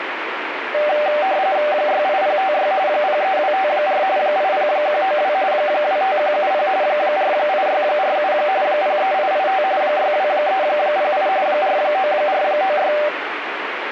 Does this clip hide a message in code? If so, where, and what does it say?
Yes: RTTY (45.45 baud, 170 Hz shift) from 0.7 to 13.1 s, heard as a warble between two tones, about 680 Hz centre, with radio static. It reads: 68056 03254 80192 25170 48647 03885 62308 49496